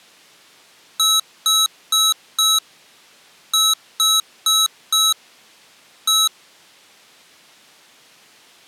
Beep code, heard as beeps from a small speaker, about 1300 Hz. 4-4-1. In Phoenix BIOS tables: serial port failure.